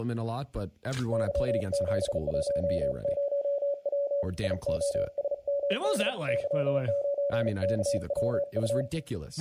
Morse code, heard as a keyed tone, hand-sent with a bug key, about 36 wpm, 570 Hz, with room echo and speech in English. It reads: Y710W IOSMD Y9KWU